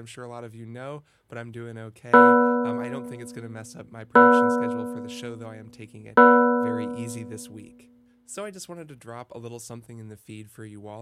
Clock strike, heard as a bell, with speech in English. 3. Three o'clock.